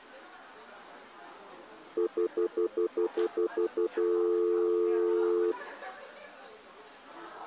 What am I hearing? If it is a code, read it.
Telephone call progress tone (North American plan), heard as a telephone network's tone, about 350, 440 Hz, 0.1 s on and 0.1 s off, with the noise of a crowd indoors. Stutter dial tone.